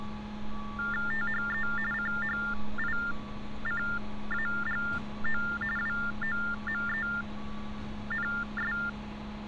TTY/TDD text telephone tones (45.45 baud Baudot), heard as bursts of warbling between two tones, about 400 Hz shift, 1600 Hz centre, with street noise. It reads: THE CHICAGO WOMENS